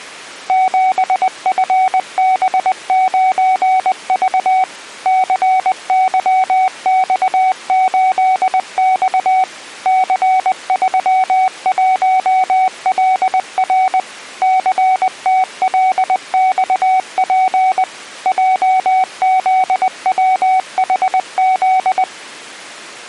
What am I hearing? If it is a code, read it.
Morse code, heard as a keyed tone, machine-sent, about 20 wpm, 750 Hz. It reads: 7FB9V CYX8X C31LR CTLXP JZWHZ